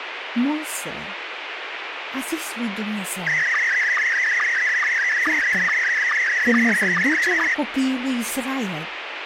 SSTV (slow-scan television), Scottie S1, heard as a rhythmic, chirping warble, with radio hiss and speech in Romanian.